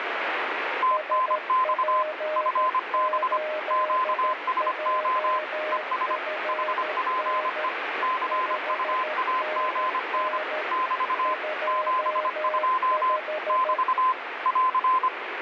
Morse code, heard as two keyed tones, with radio static. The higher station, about 25 wpm, 1030 Hz: TNX FB QSO ES HPE CUAGN <BT> 72 <BT> <AR>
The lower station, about 13 wpm, 620 Hz: SP8JFN 5NN 25